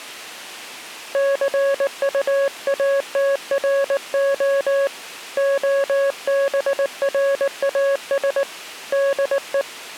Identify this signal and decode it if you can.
Morse code, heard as a keyed tone, hand-sent with a paddle, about 19 wpm, 550 Hz. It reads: CUATRO OBRAS DE